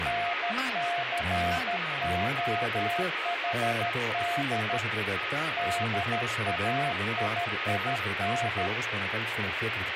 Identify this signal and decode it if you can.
Morse code, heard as a keyed tone, hand-sent with a paddle, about 13 wpm, 700 Hz, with radio static, a weaker station near 1260 Hz and speech in Greek. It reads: NCOHD DAIIN